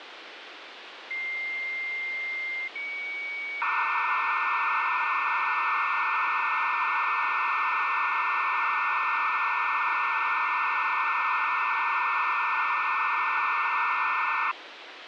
Dial-up modem handshake (low-speed, two carriers), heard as two whistles, then hiss, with phone line noise.